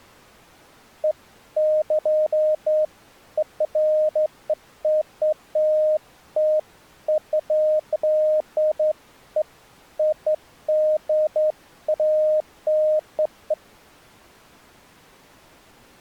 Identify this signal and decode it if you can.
Beeps of irregular length. There is no code.